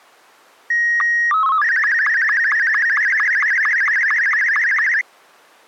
SSTV (slow-scan television), Martin M2, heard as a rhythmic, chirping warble.